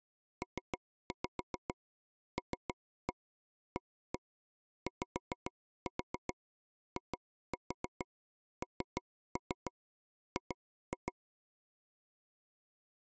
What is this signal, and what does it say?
Tap code, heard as taps on a table, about 6 knocks a second. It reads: PLAYING